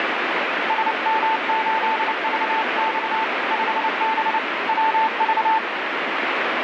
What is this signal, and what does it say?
Morse code, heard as a keyed tone, hand-sent with a paddle, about 29 wpm, 890 Hz, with heavy radio static. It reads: SM8VX 5B WV